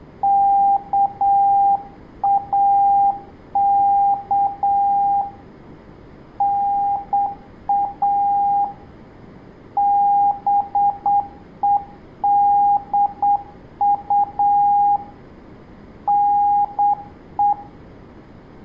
Morse code (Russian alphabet), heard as a keyed tone, hand-sent with a straight key, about 8 wpm, 810 Hz, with room echo. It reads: КАК НА БЕДУ НЕ